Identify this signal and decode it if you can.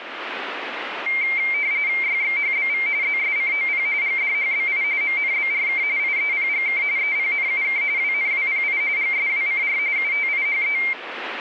RTTY (45.45 baud, 170 Hz shift), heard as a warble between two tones, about 2200 Hz centre, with radio static. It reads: YXHBV ZSCOP GDHBI MNBRK IEPGK EPNUK WNWPI GSWCR UTIHE